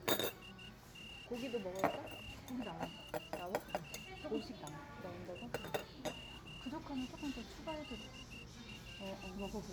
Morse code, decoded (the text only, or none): SMALL SMALL